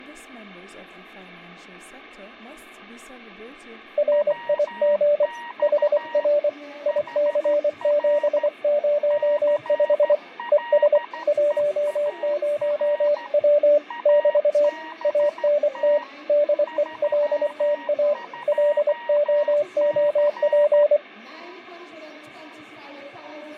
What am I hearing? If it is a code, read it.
Morse code, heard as two keyed tones, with fading. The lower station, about 24 wpm, 590 Hz: RIG HR IC705 ES 10W <BT> ANT DELTA LOOP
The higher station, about 13 wpm, 940 Hz: WX HR CLEAR ABT 32C